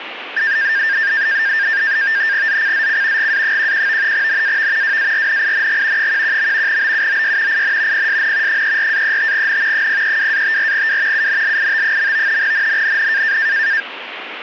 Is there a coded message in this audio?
Yes: NAVTEX (SITOR-B), 100 baud, 170 Hz shift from 0.4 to 13.8 s, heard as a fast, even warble, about 1700 Hz centre, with radio static. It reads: ZCZC GA11 NAV WARNING 11. BUOY IN PSN 34-35N 032-54W UNLIT. NNNN